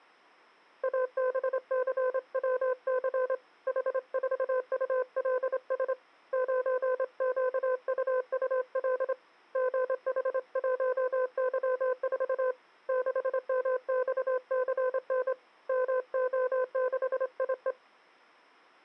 Morse code, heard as a keyed tone, hand-sent with a straight key, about 26 wpm, 510 Hz. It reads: ABCWC H4ULS 9QUUL GH1Y4 6MXCN MO6IE